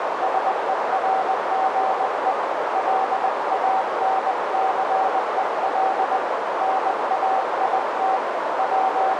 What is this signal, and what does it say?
Morse code (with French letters), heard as a keyed tone, hand-sent with a paddle, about 20 wpm, 760 Hz, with heavy radio static and a narrow filter. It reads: SERGE LANCEL NAIT …